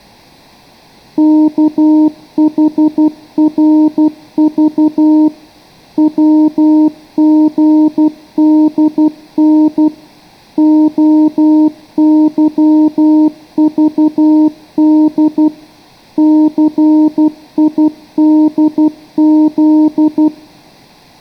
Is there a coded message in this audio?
Yes: Morse code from 1.1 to 20.3 s, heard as a keyed tone, machine-sent, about 12 wpm, 310 Hz, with room echo. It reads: KHRV WGDN OYVD CIDZ